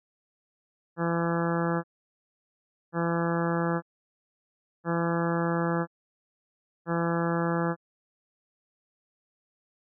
Ship horn signal, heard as a ship's horn, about 170 Hz. 4 short. At sea: a pilot vessel's identity signal in fog.